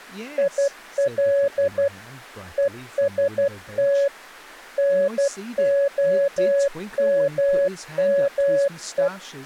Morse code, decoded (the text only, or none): IL EST NOMME